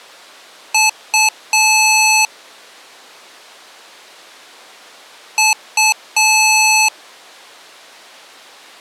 Beep code, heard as beeps from a small speaker, played twice, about 870 Hz. 2 short, 1 long.